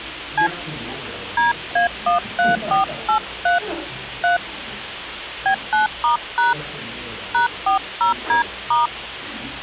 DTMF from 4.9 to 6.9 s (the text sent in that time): B9*#